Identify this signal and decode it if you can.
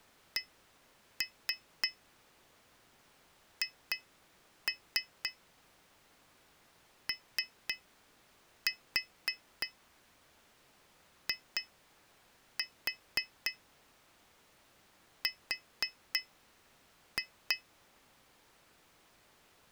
Tap code, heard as taps on glass, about 3 knocks a second. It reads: CHOIR